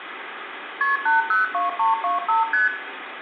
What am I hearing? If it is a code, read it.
Multi-frequency trunk signalling (R1, as on North American trunks), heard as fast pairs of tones, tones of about 150 ms, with phone line noise and room echo. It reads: KP 802325 ST